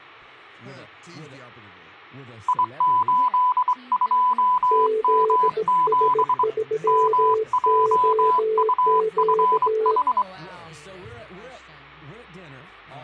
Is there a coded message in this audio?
Yes: Morse code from 2.4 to 10.3 s, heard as two keyed tones. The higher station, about 24 wpm, 1000 Hz: I82M7 MJUFH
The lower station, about 18 wpm, 440 Hz: ZS3OQ